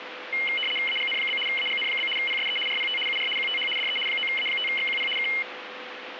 RTTY (75 baud, 850 Hz shift), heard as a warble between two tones, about 2550 Hz centre, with radio static. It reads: AGN? AGN? PSE RPT UR QTH DE 9A5XQP K